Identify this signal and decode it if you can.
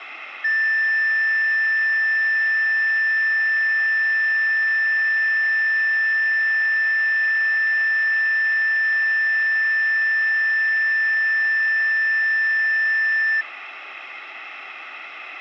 A steady tone, with room echo. There is no code.